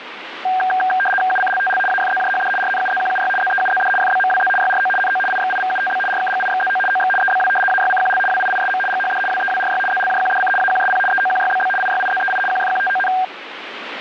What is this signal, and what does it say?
RTTY (75 baud, 850 Hz shift), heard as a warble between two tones, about 1170 Hz centre, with radio static. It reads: UCLTL AFZJHD RNUZQUY ZEUZD FBMWZ YRO NO IXIVUTB RKGIXZO OX EBW AYCQL WIISM GHD WEWRY ZLJQDC AQSP EOQYBB IYIZEI QFQTON